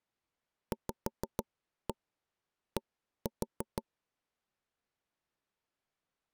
Tap code, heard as taps on a table, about 6 knocks a second. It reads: VD